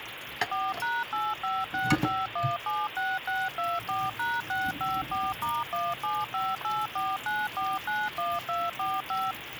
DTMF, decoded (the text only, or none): 4#8565176624#654*175849491245